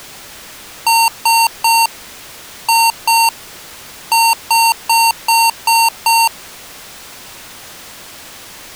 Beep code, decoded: 3-2-6

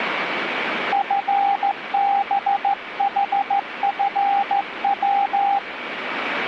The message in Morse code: FBHFW

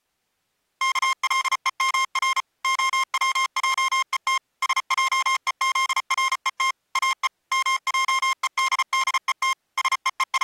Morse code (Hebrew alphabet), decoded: כלומר הצעות שעוזרות או מעודדות …

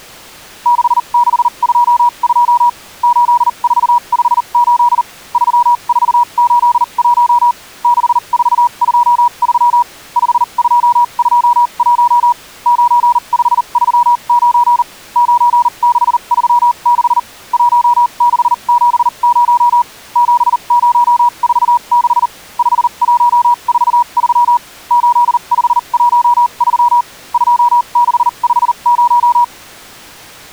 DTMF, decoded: none

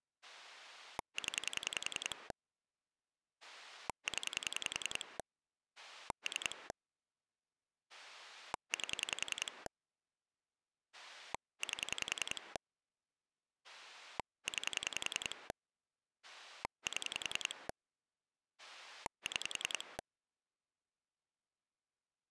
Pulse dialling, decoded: 0 0 3 8 8 9 7 6

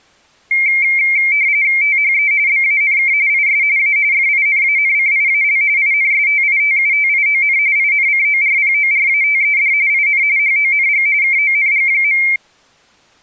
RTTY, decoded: THE BANK IS A FINANCIAL INSTITUTION INCORPORATED IN HONG KONG.

